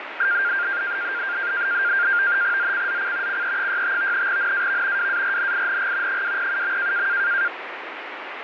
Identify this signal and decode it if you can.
NAVTEX (SITOR-B), 100 baud, 170 Hz shift, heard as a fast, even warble, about 1500 Hz centre, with radio static. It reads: ZCZC CE65 NAV WARNING 207.